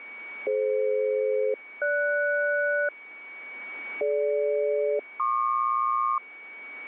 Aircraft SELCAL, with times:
0.5-2.9 DF-GS
4.0-6.2 DG-PQ

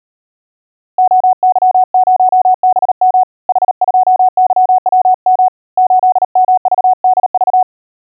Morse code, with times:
1.0-3.2 OY0BM
3.5-5.5 H2YWM
5.8-7.6 8MVDV

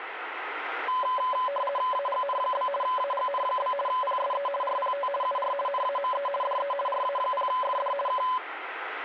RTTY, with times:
1.9-2.7 AGN?
2.8-3.7 AGN?
3.9-4.5 PSE
4.6-5.1 RPT
5.2-5.5 UR
5.7-6.3 NAME
6.4-6.7 DE
6.9-7.9 RA0FD
8.1-8.2 K

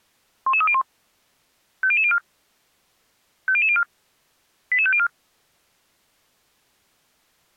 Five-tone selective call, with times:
0.5-0.8 11301
1.8-2.2 50004
3.5-3.8 50004
4.7-5.1 88504

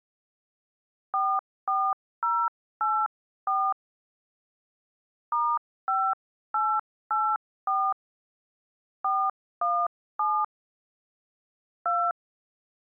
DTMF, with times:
1.1-3.7 44084
5.3-7.9 *5884
9.0-10.4 417
11.9-12.1 2

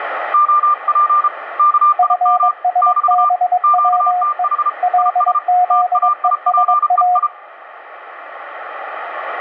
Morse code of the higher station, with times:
0.3-1.3 OP
1.6-2.5 KIM
2.8-3.3 <BT>
3.6-4.7 QTH
5.0-5.4 IS
5.7-7.3 TAIPEI

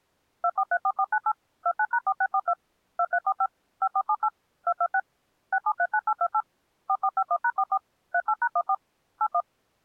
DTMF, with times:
0.4-1.3 2434498
1.7-2.5 29#4642
3.0-3.5 2345
3.8-4.3 5478
4.7-5.0 226
5.5-6.4 6739828
6.9-7.8 4451#44
8.1-8.7 38#14
9.2-9.4 81

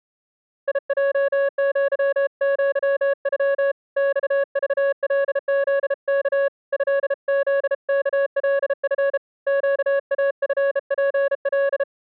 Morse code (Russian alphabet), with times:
0.7-3.7 ИЙЪЪЮ
4.0-6.5 ЬЖЛЗК
6.7-9.2 ЭЗКЛФ
9.5-11.8 ЩАФПЛ

